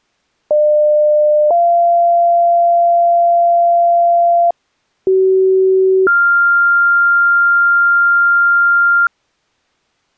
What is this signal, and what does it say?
Two-tone page, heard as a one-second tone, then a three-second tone, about 600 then 690 Hz, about 380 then 1400 Hz.